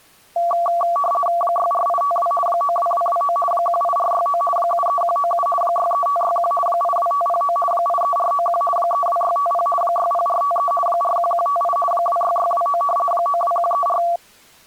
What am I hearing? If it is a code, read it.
RTTY (50 baud, 450 Hz shift), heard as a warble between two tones, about 910 Hz centre. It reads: 64852 92229 18469 73197 63561 82509 83491 32650 60453 41158 26629 92134